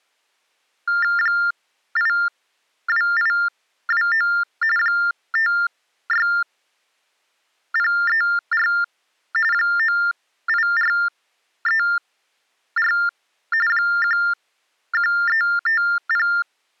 TTY/TDD text telephone tones (45.45 baud Baudot), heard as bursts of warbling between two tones, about 400 Hz shift, 1600 Hz centre. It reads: 82829 56034 98434 11350